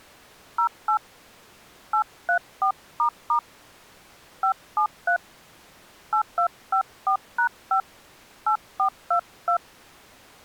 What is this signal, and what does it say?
DTMF, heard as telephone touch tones, dialled by hand, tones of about 90 ms. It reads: 08 834** 573 8254#5 8422